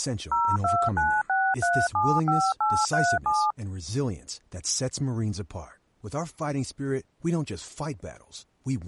DTMF, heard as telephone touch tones, dialled by machine, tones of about 250 ms, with speech in English. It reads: 0296375837